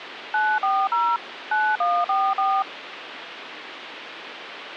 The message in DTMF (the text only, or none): 940 9144